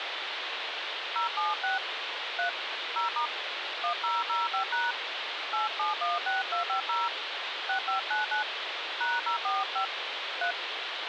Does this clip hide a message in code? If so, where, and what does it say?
Yes: DTMF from 1.2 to 10.5 s, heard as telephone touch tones, dialled by hand, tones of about 140 ms, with phone line noise. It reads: 076 3 0* 1005# 8716250 6599 #045 3